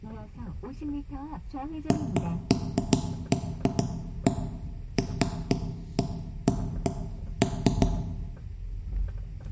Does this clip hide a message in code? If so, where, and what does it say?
No, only irregular knocks on wood, with room echo and the noise inside a car.